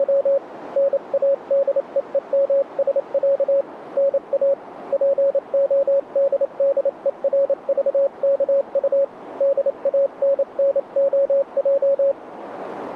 Morse code (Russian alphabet), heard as a keyed tone, hand-sent with a paddle, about 28 wpm, 550 Hz, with radio static. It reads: … НАДЕЕМСЯ НА ПОДДЕРЖКУ ДАННОЙ